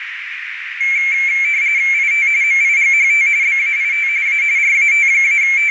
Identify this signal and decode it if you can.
RTTY (45.45 baud, 170 Hz shift), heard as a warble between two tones, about 2250 Hz centre, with radio static and a narrow filter. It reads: IT MIGHT BAIT A …